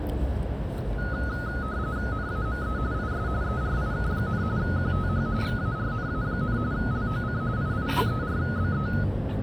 RTTY (45.45 baud, 170 Hz shift), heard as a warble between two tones, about 1360 Hz centre, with the noise of a residential street. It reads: NAME IS ERIK, QTH VARNA, LOC II34BE